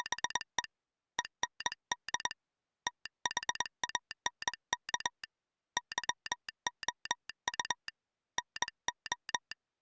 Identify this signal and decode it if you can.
Morse code, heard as a telegraph sounder, hand-sent with a straight key, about 21 wpm. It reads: … END THANK YOU NO